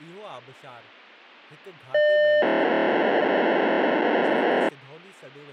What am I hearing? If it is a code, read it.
POCSAG pager data (1200 baud), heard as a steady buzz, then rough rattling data, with speech in Sindhi.